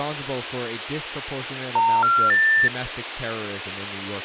Telephone call progress tone (North American plan), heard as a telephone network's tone, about 910, 1370, 1800 Hz, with phone line noise and speech in English. Special information tone.